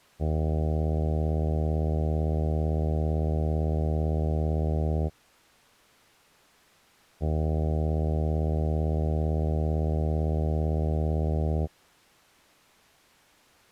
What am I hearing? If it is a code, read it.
Ship horn signal, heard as a ship's horn, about 80 Hz. 2 long. At sea: a vessel under power that has stopped in fog.